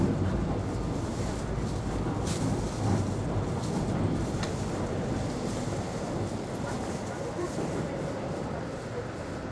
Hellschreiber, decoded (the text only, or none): none